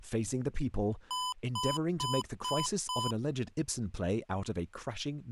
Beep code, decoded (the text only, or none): 5 short